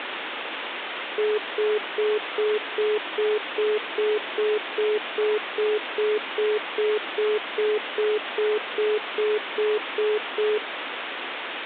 Telephone call progress tone (single-tone plan, as in most of Europe), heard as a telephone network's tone, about 420 Hz, 0.2 s on and 0.2 s off, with phone line noise. Congestion tone.